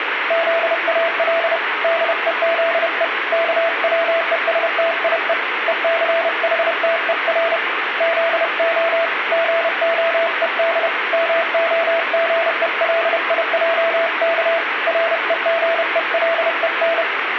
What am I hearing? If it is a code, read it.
Morse code, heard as a keyed tone, hand-sent with a paddle, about 31 wpm, 670 Hz, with radio static. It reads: ZAL DEZE KWESTIE ECHTER ZO GOED MOGELIJK REGELEN